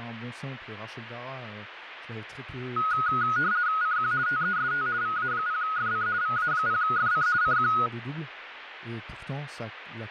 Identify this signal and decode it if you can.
RTTY (50 baud, 170 Hz shift), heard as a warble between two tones, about 1360 Hz centre, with radio static and speech in French. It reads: CQ TEST VA0FC VA0FC CQ